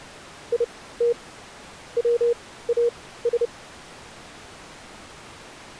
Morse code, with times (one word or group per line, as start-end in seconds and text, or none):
0.5-1.1 IT
2.0-3.5 WAS